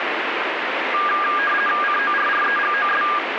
RTTY (50 baud, 450 Hz shift), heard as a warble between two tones, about 1420 Hz centre, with radio static. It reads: CORREGOS